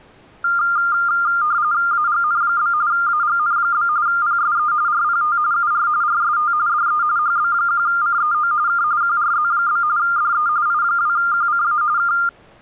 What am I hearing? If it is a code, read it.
RTTY (45.45 baud, 170 Hz shift), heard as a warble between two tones, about 1300 Hz centre. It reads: AGN? AGN? PSE RPT UR RST DE HB1CEO K QRZ? DE I2QCA K